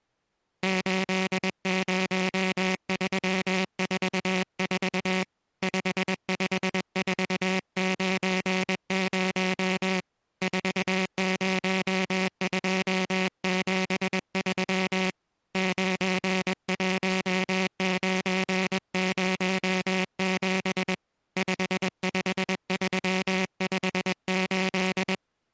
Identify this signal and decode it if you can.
Morse code, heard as a buzzer, hand-sent with a paddle, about 21 wpm. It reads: 80344 55490 40273 91907 55358